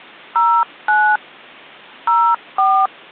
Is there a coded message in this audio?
Yes: DTMF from 0.4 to 2.9 s, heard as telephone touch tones, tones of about 280 ms. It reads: 09 04